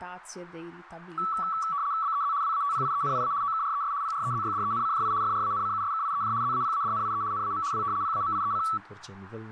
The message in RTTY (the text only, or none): BEZ WATPIENIA OKRES PREZYDENCJI FRANCUSKIEJ ZAPADNIE NAM W PAMIEC